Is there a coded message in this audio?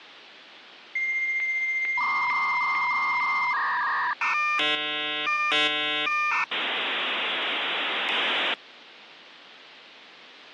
Yes: dial-up modem handshake (V.34 or later) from 1.0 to 8.5 s, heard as a whistle, warbles, then hiss, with phone line noise.